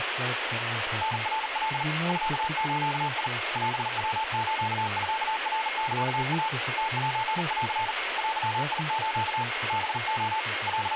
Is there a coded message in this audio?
Yes: Morse code (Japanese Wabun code) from 1.0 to 11.0 s, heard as a keyed tone, hand-sent with a bug key, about 40 wpm, 880 Hz, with radio static, a weaker station near 2150 Hz and speech in English. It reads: タナカ ミズ オヤスミナサイ ムセン デス ハレ …